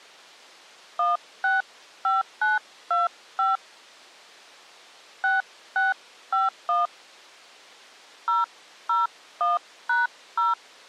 DTMF, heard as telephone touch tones, dialled by hand, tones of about 160 ms. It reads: 165925 6651 001#0